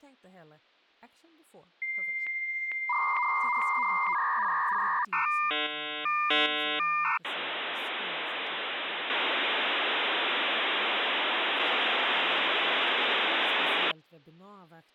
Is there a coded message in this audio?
Yes: dial-up modem handshake (V.34 or later) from 1.8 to 13.9 s, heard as a whistle, warbles, then hiss, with speech in Swedish.